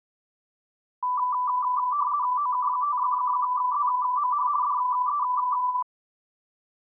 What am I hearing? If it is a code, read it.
RTTY (50 baud, 170 Hz shift), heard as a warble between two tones, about 1080 Hz centre. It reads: OK5ZMH DE